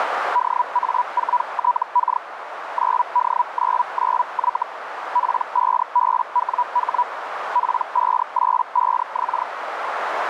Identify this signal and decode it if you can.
Hellschreiber (Feld-Hell, 122.5 baud), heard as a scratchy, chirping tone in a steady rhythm, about 980 Hz, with radio static and a narrow filter. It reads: DA4TK 9D99Y P5BWH P585X